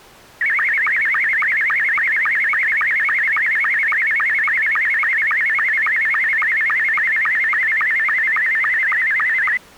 SSTV (slow-scan television), Scottie S2, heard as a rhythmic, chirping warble.